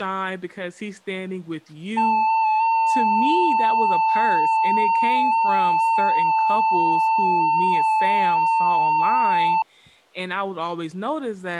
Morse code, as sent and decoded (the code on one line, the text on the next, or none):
none